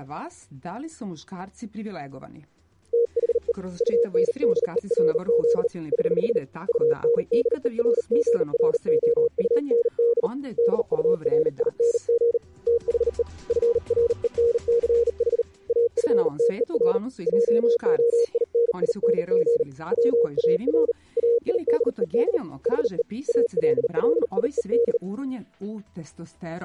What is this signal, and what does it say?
Morse code, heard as a keyed tone, hand-sent with a bug key, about 39 wpm, 470 Hz. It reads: THE UNDERZ <HH> UNDERGROUND DURING THE FRENCH AFTER JOINING WAR AIDED HE ALLIED